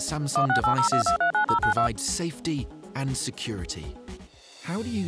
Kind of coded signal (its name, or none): DTMF